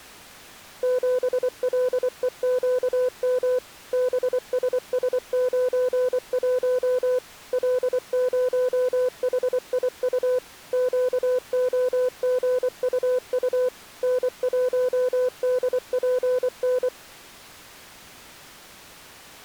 Morse code, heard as a keyed tone, machine-sent, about 24 wpm, 500 Hz. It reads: 7LEQM BSS91 L0HIU QOGUU N1DPN